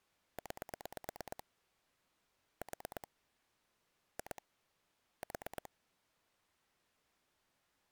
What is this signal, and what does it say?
Pulse dialling, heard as clicks on a phone line, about 8 pulses a second. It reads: 9 4 2 4